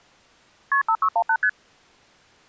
Multi-frequency trunk signalling (R1, as on North American trunks), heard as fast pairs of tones, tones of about 70 ms. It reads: KP 5618 ST